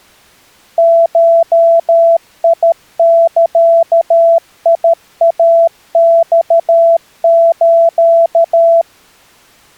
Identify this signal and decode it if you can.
Morse code (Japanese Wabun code), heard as a keyed tone, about 13 wpm, 670 Hz. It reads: ゴザイマス